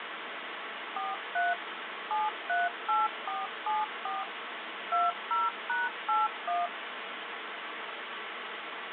DTMF, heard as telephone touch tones, dialled by machine, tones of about 180 ms, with phone line noise. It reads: 43 738474 20#81